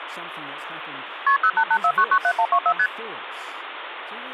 Multi-frequency trunk signalling (R1, as on North American trunks), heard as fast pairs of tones, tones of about 70 ms, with phone line noise and speech in English. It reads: KP 0884997124 ST